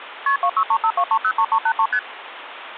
Multi-frequency trunk signalling (R1, as on North American trunks), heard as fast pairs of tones, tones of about 70 ms, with phone line noise. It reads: KP 26352303383 ST